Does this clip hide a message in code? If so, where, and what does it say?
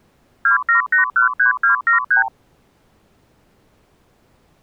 Yes: multi-frequency trunk signalling (R2, with the far end's replies) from 0.4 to 2.3 s, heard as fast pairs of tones, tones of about 120 ms. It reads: 27813273